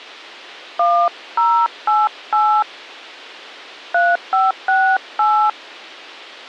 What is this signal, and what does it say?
DTMF, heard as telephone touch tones, dialled by hand, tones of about 270 ms. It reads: 1088 3568